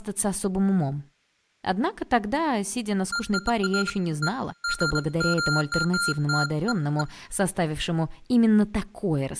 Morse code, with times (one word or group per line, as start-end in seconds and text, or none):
none